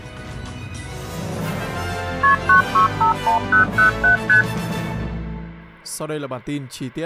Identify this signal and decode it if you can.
Multi-frequency trunk signalling (R1, as on North American trunks), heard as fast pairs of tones, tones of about 120 ms. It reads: KP 9651007 ST